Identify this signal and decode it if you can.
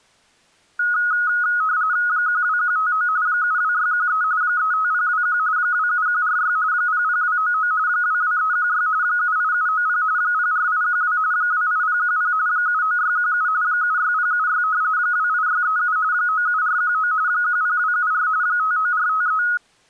RTTY (45.45 baud, 170 Hz shift), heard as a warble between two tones, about 1360 Hz centre. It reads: 12159 72613 35021 27146 00299 22316 78790 04812 28010 79617 76076 28637 97419 10274 59453